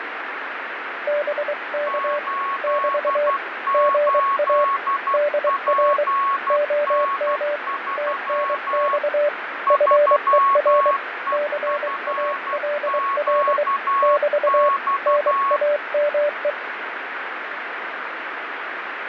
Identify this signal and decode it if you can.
Morse code, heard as two keyed tones, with radio static and fading. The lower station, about 23 wpm, 590 Hz: BK <BT> GA DR OM TNX FER CALL <BT> NAME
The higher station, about 12 wpm, 1100 Hz: 88PN3 3EFQX